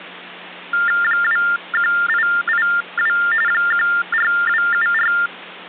TTY/TDD text telephone tones (45.45 baud Baudot), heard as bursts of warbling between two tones, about 400 Hz shift, 1600 Hz centre, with hum. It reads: 21882 14274